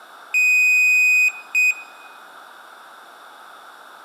Beep code, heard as a piezo beeper, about 2500 Hz, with room echo. 1 long, 1 short. In IBM BIOS tables: system board problem.